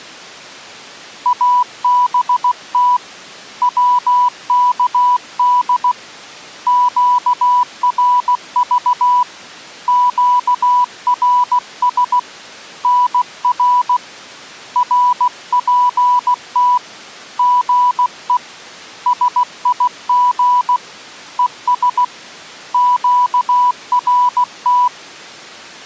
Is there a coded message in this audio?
Yes: Morse code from 1.2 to 24.9 s, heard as a keyed tone, hand-sent with a paddle, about 16 wpm, 990 Hz. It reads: ABT WKD QRV QRS NR RPT GE SIG ES QRT